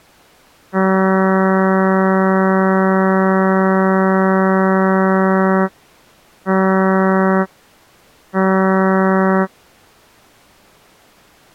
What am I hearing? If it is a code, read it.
Ship horn signal, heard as a ship's horn, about 190 Hz. 1 long, 2 short. At sea: a vessel in fog that is sailing, fishing, towing or hampered.